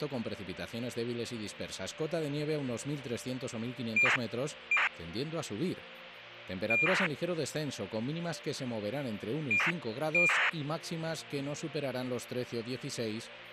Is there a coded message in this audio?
Yes: ACARS aircraft data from 4.0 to 10.5 s, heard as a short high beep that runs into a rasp, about 2400 baud, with radio hiss.